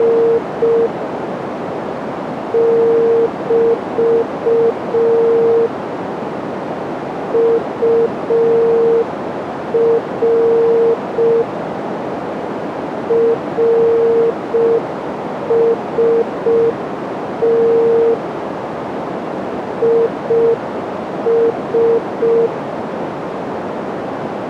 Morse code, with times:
0.0-0.9 …
2.5-5.7 <BT>
7.3-11.4 UR
13.1-18.1 RST
19.8-22.5 IS

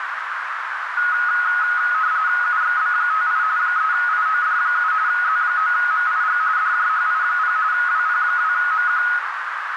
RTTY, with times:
2.4-3.4 UXB58
3.6-4.9 3IOD7
5.1-6.4 Z9MIG
6.6-7.6 DJHI0
7.7-9.0 WP2MQ

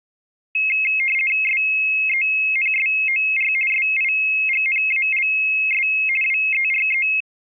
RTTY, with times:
1.4-3.5 SENSOR
3.7-5.9 SIGNALS
6.2-7.1 WERE

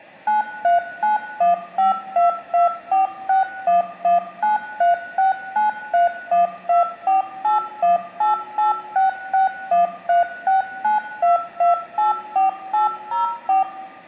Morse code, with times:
none

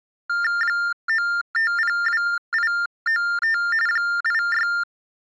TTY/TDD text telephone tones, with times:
0.6-3.6 9502895
3.9-4.7 86

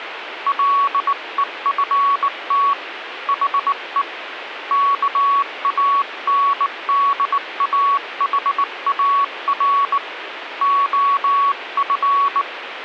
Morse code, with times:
0.5-2.7 LEFT
3.3-4.0 HE
4.7-10.0 KANDAHAR
10.6-12.4 OF

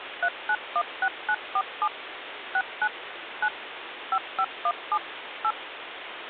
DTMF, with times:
0.2-1.9 3916947
2.5-2.9 69
3.4-3.5 9
4.1-5.0 5517
5.4-5.5 8

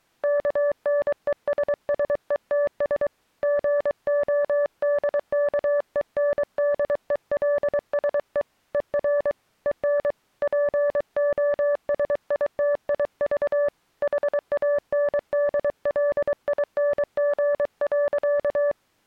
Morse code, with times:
0.2-3.1 KNESSETS
3.4-8.4 GODKENDELSE
8.7-9.3 ER
9.7-10.1 EN
10.4-13.7 POSITIV
14.0-18.7 HANDLING.

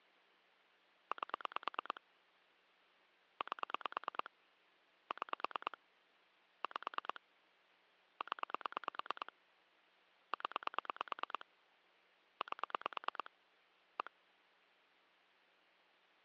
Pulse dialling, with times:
1.1-2.0 8
3.4-4.3 8
5.1-5.8 6
6.6-7.2 5
8.2-9.3 0
10.3-11.5 0
12.4-13.3 8
14.0-14.1 1

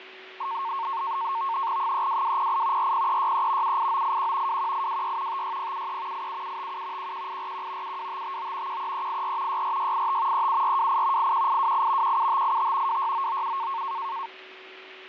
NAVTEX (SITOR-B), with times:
1.8-2.9 32208
2.8-3.8 40363
3.6-4.6 78981
4.5-5.4 21826
5.3-6.3 56073
6.1-7.1 87757
7.0-8.0 11841
7.8-8.8 72559
8.7-9.6 13384
9.5-10.5 64685
10.3-11.3 37428
11.2-12.2 81828
12.0-13.0 17585
12.9-13.8 26997

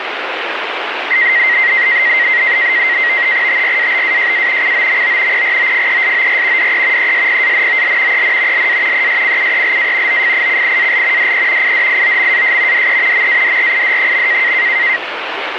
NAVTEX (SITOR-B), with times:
3.5-4.7 TRABAJA
4.6-5.4 COMO
5.3-6.7 PROFESOR
6.6-7.1 DE
7.0-8.2 ESPANOL
8.1-8.7 EN
8.5-9.1 LA
8.9-10.2 ESCUELA
10.1-11.3 OFICIAL
11.2-11.7 DE
11.6-12.9 IDIOMAS
12.7-13.3 DE
13.1-14.5 MADRID.

